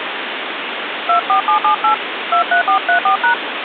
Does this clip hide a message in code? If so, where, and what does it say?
Yes: DTMF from 1.1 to 3.3 s, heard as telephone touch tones, dialled by hand, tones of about 100 ms, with phone line noise. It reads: 24778 23434#